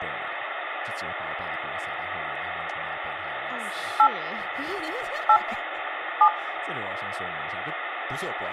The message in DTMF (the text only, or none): 8 8 7